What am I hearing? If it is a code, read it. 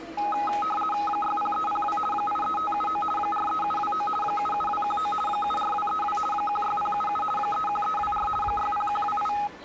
RTTY (50 baud, 450 Hz shift), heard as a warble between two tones, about 1050 Hz centre, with the noise of a crowd indoors. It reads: 60302 83579 43729 77219 74232 16077 31324 60128